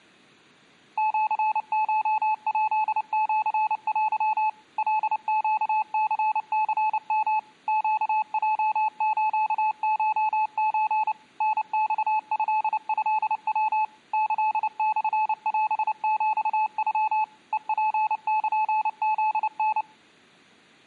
Morse code (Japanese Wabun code), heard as a keyed tone, machine-sent, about 29 wpm, 860 Hz. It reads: シコヱシテ カネニニヨ ネヲスコソ タマトトヤ キモオヒノ ヘツルフタ